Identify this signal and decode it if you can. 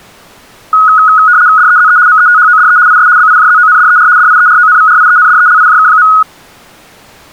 RTTY (75 baud, 170 Hz shift), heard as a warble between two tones, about 1360 Hz centre. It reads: DEZE METHODE IS BIJZONDER DIERONVRIENDELIJK.